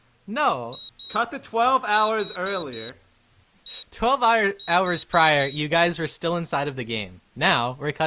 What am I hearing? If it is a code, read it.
Beep code, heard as a piezo beeper, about 3800 Hz, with speech in English. 2-4-1-4.